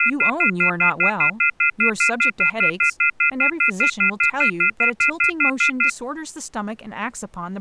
Telephone call progress tone (North American plan), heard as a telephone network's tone, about 1400, 2050, 2450, 2600 Hz, 0.1 s on and 0.1 s off, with speech in English. Off-hook warning tone.